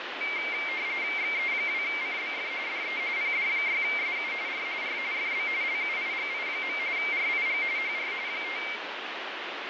RTTY (45.45 baud, 170 Hz shift), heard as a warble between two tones, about 2200 Hz centre, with radio static. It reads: XE2CBF DE PD6SU R R FB LUIGI. RIG HR 5